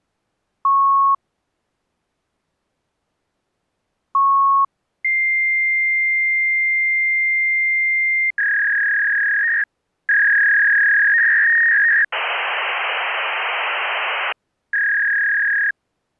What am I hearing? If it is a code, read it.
Fax machine handshake, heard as beeps, a long tone, a warble and hiss.